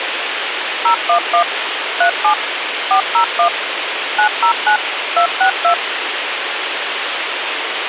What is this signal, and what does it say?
DTMF, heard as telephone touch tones, dialled by machine, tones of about 100 ms, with radio hiss and a squelch burst at the end. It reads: 011 37 401 909 262